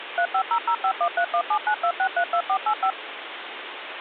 DTMF, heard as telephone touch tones, dialled by machine, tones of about 80 ms, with phone line noise. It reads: 35005131792632485